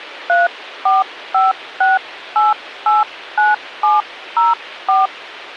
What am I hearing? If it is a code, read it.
DTMF, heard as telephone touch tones, dialled by hand, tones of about 170 ms, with radio hiss. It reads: 3456889704